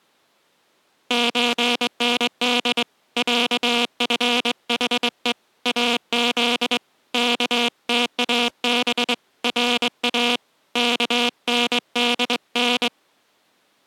Morse code (Persian alphabet), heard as a buzzer, hand-sent with a straight key, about 22 wpm. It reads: چند صفحه از کتاب را کندن